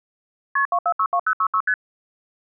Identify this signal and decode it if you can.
Multi-frequency trunk signalling (R1, as on North American trunks), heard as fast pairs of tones, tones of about 70 ms. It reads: KP 2462066 ST